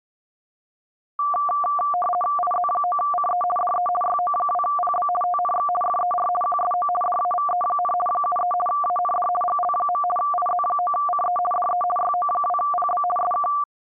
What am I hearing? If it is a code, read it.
RTTY (50 baud, 450 Hz shift), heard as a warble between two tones, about 940 Hz centre. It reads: IZ9CE DE YO2PB TNX FER QSO DAVE, 73 AND GL. IZ9CE DE YO2PB SK